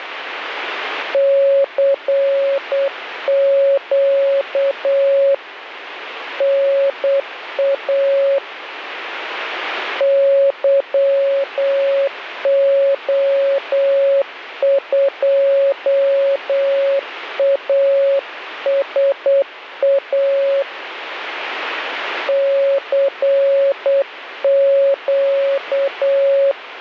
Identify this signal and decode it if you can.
Morse code, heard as a keyed tone, hand-sent with a paddle, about 8 wpm, 550 Hz, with radio static. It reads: CQ NA YO2ASA CQ